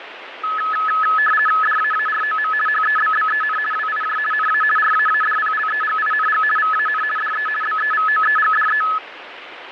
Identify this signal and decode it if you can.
RTTY (50 baud, 450 Hz shift), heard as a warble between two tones, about 1500 Hz centre, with radio static. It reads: DAAROM HEBBEN WIJ NA RAADPLEGING VAN DE BEVOEGDE